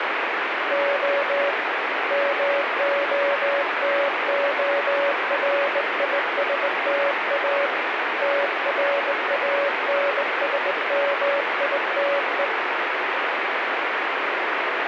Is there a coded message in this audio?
Yes: Morse code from 0.6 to 12.5 s, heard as a keyed tone, hand-sent with a straight key, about 20 wpm, 560 Hz, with heavy radio static. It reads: O MOTORISTA TRANSMITE